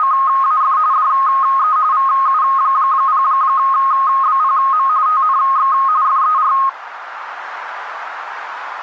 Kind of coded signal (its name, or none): RTTY